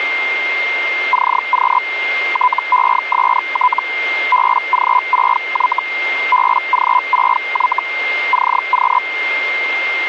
Hellschreiber (Feld-Hell, 122.5 baud), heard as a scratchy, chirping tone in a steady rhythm, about 1000 Hz, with radio static and a steady whistle near 2110 Hz. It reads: CQ TEST BG6Y BG6Y CQ